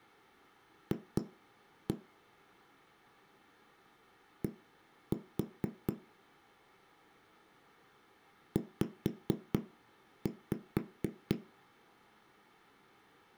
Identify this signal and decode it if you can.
Tap code, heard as knocks on a wall, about 4 knocks a second. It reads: F D Z